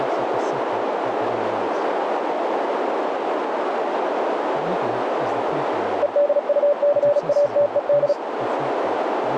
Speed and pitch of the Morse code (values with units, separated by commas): 36 wpm, 580 Hz